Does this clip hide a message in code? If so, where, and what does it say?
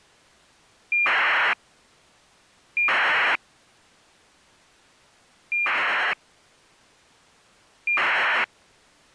Yes: ACARS aircraft data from 0.9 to 8.4 s, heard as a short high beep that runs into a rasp, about 2400 baud.